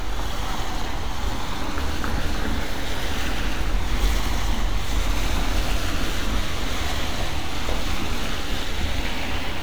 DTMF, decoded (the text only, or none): none